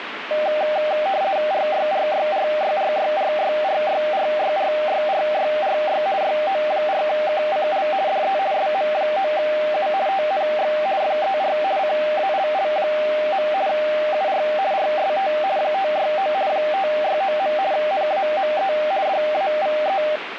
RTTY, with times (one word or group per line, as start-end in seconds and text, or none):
1.5-6.0 RYRYRYRYRYRYRYRYRYRY
6.2-7.9 YO4KCL
8.1-8.4 DE
8.5-9.9 SM9U
10.1-10.7 TNX
11.0-11.6 FER
11.8-13.5 CALL.
13.7-14.4 UR
14.7-15.3 RST
15.6-16.3 569
16.5-17.5 569.
17.7-18.7 NAME
19.1-20.0 DAVE